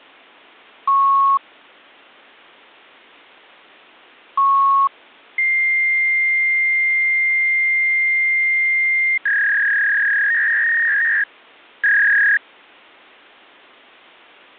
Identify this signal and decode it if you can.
Fax machine handshake, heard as beeps, a long tone and a warble.